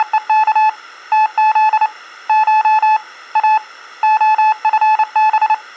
Morse code (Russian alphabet), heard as a keyed tone, hand-sent with a paddle, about 29 wpm, 860 Hz. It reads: … ТЗ Ш А ОФБ